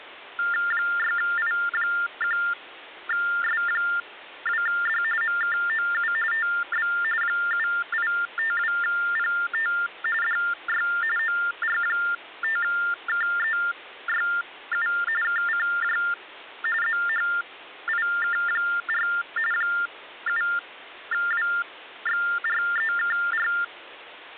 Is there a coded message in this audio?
Yes: TTY/TDD text telephone tones (45.45 baud Baudot) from 0.4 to 23.6 s, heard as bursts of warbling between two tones, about 400 Hz shift, 1600 Hz centre. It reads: 6I1S2D MKOU TB 7852PT DY OR5KEYU KCJ ZHIK4 7WXREKR